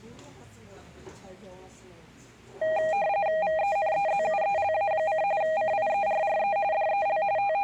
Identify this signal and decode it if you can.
RTTY (45.45 baud, 170 Hz shift), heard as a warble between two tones, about 720 Hz centre, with the noise of a cafe. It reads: VENEZUELA: CIERRE DEL …